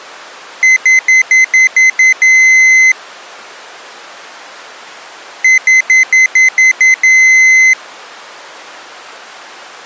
Beep code, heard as a piezo beeper, played twice, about 2050 Hz. 7 short, 1 long.